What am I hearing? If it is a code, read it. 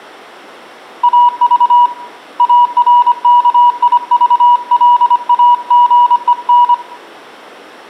Morse code, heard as a keyed tone, hand-sent with a paddle, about 25 wpm, 970 Hz, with room echo. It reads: AV ARKIVLAGEN